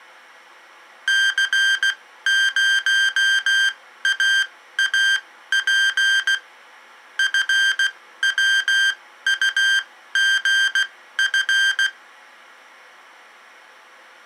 Morse code, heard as electronic beeps, machine-sent, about 16 wpm, spaced as for 13 wpm, 1600 Hz. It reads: C0AAP FWUGF